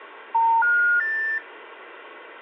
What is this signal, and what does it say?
Telephone call progress tone (North American plan), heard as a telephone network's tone, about 910, 1430, 1800 Hz, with phone line noise. Special information tone.